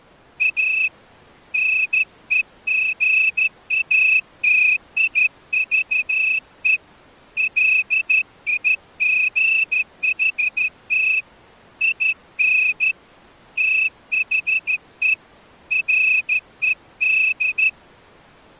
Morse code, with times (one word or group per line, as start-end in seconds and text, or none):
0.4-0.9 A
1.5-6.8 NEGATIVE
7.4-11.2 LIGHT
11.8-12.9 IN
13.6-15.1 THE
15.7-17.7 RED